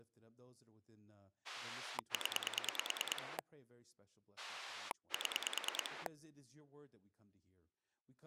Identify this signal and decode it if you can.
Pulse dialling, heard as a rotary dial, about 9 pulses a second, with speech in English. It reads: 0 7